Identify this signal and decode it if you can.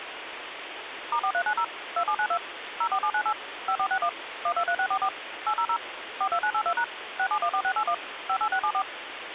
DTMF, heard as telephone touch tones, dialled by machine, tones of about 70 ms, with phone line noise. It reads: *4390 2792 04798 5461 123644 800 42982# 6714681 58674